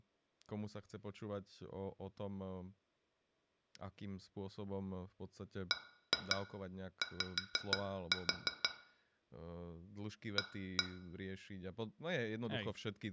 Tap code, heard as taps on glass, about 6 knocks a second, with room echo and speech in Slovak. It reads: BY A